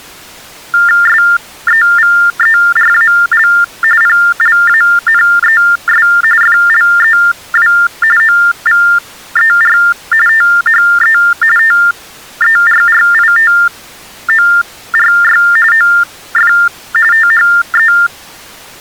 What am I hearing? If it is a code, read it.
TTY/TDD text telephone tones (45.45 baud Baudot), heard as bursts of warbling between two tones, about 400 Hz shift, 1600 Hz centre. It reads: SEVERAL PLANES FLEW OVER THE TERRITORY OF THE